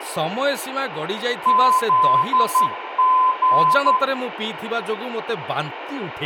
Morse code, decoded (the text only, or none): ZG